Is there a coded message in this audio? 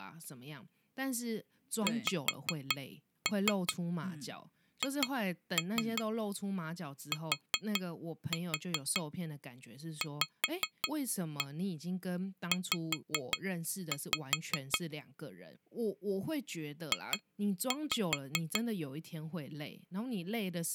Yes: tap code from 1.9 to 18.7 s, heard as taps on glass, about 5 knocks a second, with speech in Chinese. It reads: XHTVZ J